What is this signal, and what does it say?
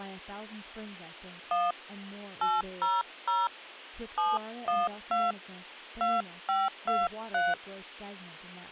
DTMF, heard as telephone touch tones, dialled by hand, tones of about 200 ms, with speech in English. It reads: 1 800 712 2523